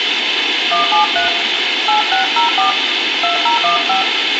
DTMF, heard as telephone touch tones, dialled by hand, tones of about 120 ms, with radio hiss and room echo. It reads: 173 8604 2015